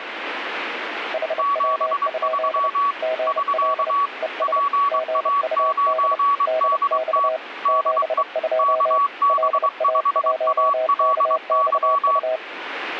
Morse code, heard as two keyed tones, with radio static. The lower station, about 30 wpm, 640 Hz: HW? GL ES GUD DX 72 LA1KXU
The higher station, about 23 wpm, 1130 Hz: 73 <SK> PA9DT DE KB5ALY